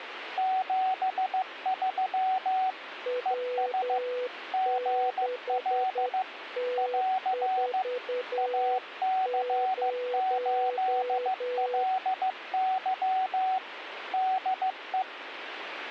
Morse code, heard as two keyed tones, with radio static. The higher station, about 15 wpm, 750 Hz: 73 ES GL <AR> AC8LY DE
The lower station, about 10 wpm, 500 Hz: W6T40